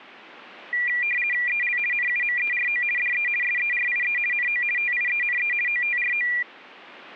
RTTY (50 baud, 450 Hz shift), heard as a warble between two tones, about 2150 Hz centre. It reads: EL NUMERO DE SERIE NO TIENE OTRO